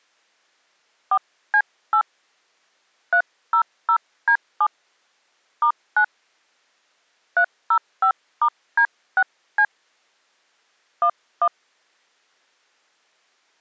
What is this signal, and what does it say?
DTMF, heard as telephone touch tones, dialled by hand, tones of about 70 ms. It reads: 4C8 300D7 *9 305*D6C 11